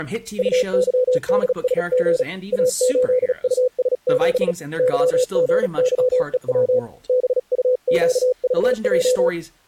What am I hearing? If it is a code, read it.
Morse code, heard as a keyed tone, hand-sent with a paddle, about 37 wpm, 500 Hz, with speech in English. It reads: UYDSG A8US7 YGYEW BUQVJ